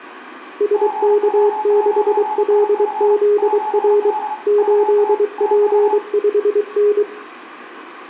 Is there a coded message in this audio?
Yes: Morse code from 0.5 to 7.1 s, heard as two keyed tones, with room echo. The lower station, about 23 wpm, 410 Hz: SK6LZR 8P5N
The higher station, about 30 wpm, 860 Hz: GW9IF 7D UT TU